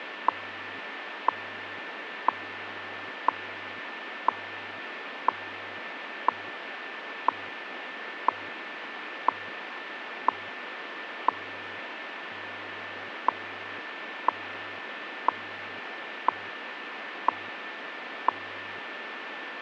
Radio time signal (WWV, Colorado), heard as ticks, one a second, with radio static.